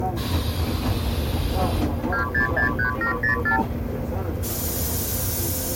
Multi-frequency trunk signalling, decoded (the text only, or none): 2663704